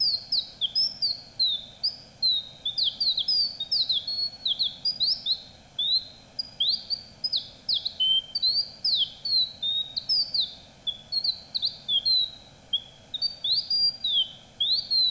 Bird-like chirps, with room echo. There is no code.